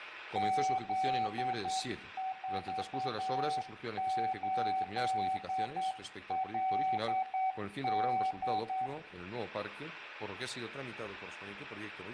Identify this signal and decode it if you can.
Morse code, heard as a keyed tone, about 9 wpm, 760 Hz, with room echo. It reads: Z48LD